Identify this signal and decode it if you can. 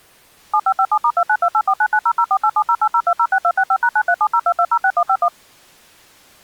DTMF, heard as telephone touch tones, dialled by machine, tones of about 60 ms. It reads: 7557*292849900487080206265#93702206151